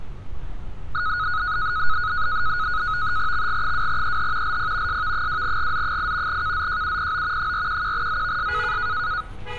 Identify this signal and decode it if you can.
NAVTEX (SITOR-B), 100 baud, 170 Hz shift, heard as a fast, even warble, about 1360 Hz centre, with street noise. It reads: XG2EH LP SV2GZ8 KZJUPO 411ZVS